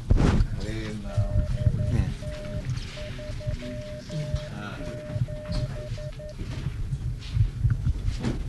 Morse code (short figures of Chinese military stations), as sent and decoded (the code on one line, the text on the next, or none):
-.. - ...-- --...
8037